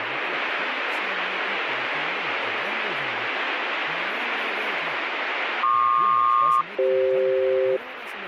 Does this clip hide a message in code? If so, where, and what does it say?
Yes: aircraft SELCAL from 5.6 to 7.8 s, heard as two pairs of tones, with radio static and speech in Hindi. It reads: PQ-CF